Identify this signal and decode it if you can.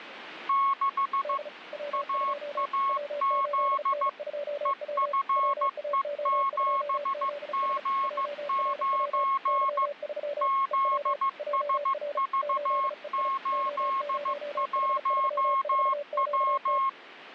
Morse code, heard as two keyed tones, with radio static. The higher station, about 15 wpm, 1090 Hz: 6 AAZ EFE7G9 ZSV81W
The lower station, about 35 wpm, 570 Hz: D W2 W8N2W WAO2ZS JRW Y3 EW JR 8EI O0H34QT